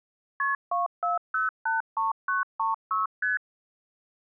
Multi-frequency trunk signalling (R1, as on North American trunks), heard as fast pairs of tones, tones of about 150 ms. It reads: KP 24083936 ST